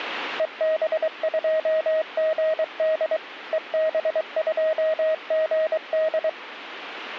Morse code, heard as a keyed tone, machine-sent, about 23 wpm, 630 Hz. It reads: EB2GD EB2GD